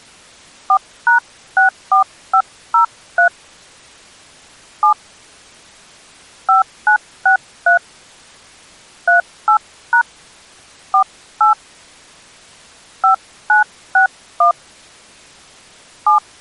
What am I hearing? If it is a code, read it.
DTMF, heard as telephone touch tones, dialled by hand, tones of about 100 ms. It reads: 4#64503 7 5963 38# 48 5961 7